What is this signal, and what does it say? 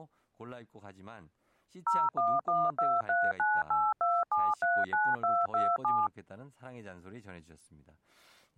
DTMF, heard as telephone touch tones, dialled by machine, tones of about 220 ms, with speech in Korean. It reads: 01123982739227